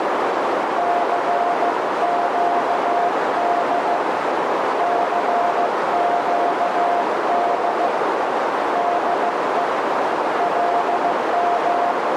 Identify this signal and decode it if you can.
Morse code, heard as a keyed tone, hand-sent with a straight key, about 15 wpm, 700 Hz, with heavy radio static and a narrow filter. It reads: CQD CQD DE …